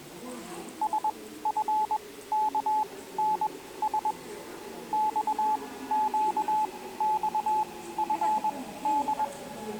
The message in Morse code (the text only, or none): SFKNS XQXFD